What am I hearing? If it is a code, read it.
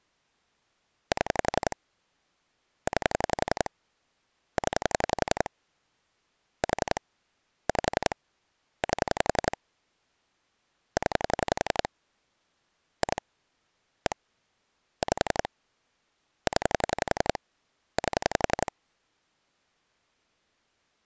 Pulse dialling, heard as clicks on a phone line, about 11 pulses a second. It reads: 7 9 0 4 5 8 0 2 1 5 0 8